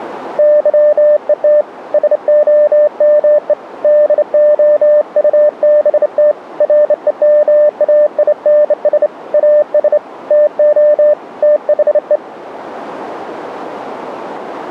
Morse code, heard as a keyed tone, hand-sent with a straight key, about 28 wpm, 600 Hz. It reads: YET SOME DOUBT REMAINS AS TO THE